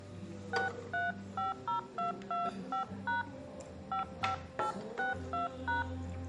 DTMF, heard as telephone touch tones, dialled by hand, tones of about 140 ms, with the noise of a restaurant. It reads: 6350225# 55862#